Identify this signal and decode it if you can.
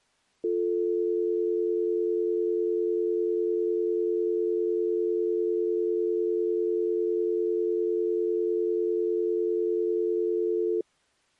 Telephone call progress tone (North American or UK plan), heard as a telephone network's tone, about 350, 440 Hz. Dial tone.